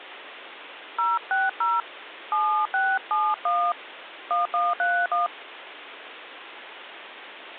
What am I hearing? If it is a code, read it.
DTMF, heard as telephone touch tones, dialled by hand, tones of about 250 ms, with phone line noise. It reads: 060 7671 1131